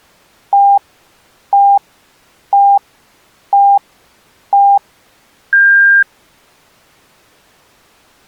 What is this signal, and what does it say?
Radio time signal (five pips and a higher one, as on Chinese radio), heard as pips.